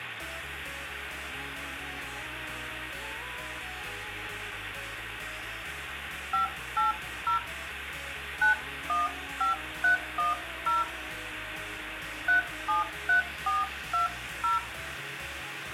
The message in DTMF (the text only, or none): 580 915310 373420